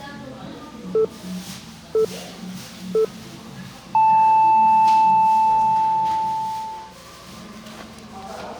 Radio time signal (three low pips and a long one an octave up, as on NHK), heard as pips, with the noise of a crowd indoors.